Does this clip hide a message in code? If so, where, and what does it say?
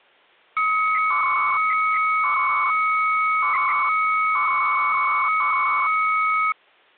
Yes: 300-baud modem data (Bell 103 tones) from 0.6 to 6.5 s, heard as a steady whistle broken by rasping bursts, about 300 baud, 200 Hz shift.